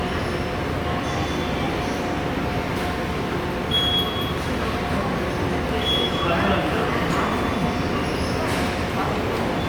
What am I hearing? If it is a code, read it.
The noise of a subway station. There is no code.